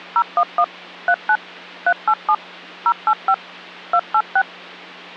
DTMF, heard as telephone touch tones, dialled by machine, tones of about 60 ms, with hum. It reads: 011 39 387 085 286